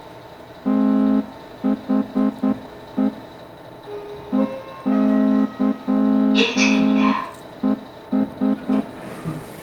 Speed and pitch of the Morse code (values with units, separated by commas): 9 wpm